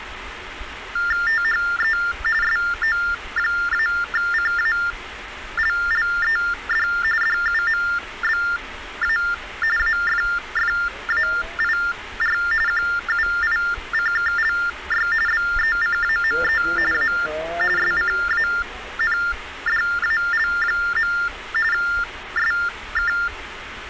TTY/TDD text telephone tones (45.45 baud Baudot), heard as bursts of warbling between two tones, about 400 Hz shift, 1600 Hz centre, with phone line noise. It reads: THE SO-CALLED DUMBA AFFAIR QUICKLY BECAME A SCANDAL. SK